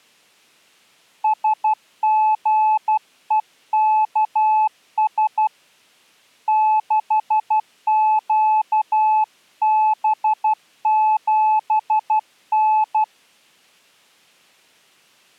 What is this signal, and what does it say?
Morse code, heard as a keyed tone, hand-sent with a paddle, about 12 wpm, 860 Hz. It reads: SGEKS 6QB7N